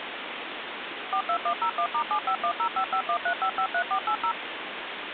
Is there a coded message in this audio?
Yes: DTMF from 1.1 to 4.3 s, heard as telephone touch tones, dialled by machine, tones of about 80 ms, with phone line noise. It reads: 42101*75105513553480